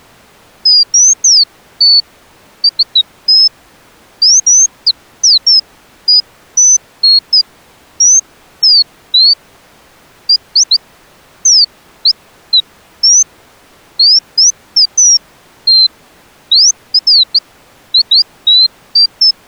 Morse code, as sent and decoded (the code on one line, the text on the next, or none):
none